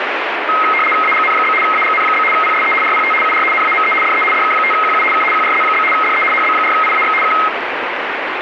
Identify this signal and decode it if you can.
RTTY (75 baud, 850 Hz shift), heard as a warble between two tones, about 1700 Hz centre, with radio static. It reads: AGN? AGN? PSE RPT UR NAME DE DK5QU K QRZ? DE HB4IAX K